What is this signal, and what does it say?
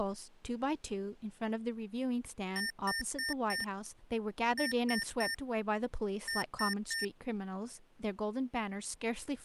Beep code, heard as beeps from a small speaker, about 1800 Hz, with speech in English. 4-3-3. In Phoenix BIOS tables: timer channel 2 failure.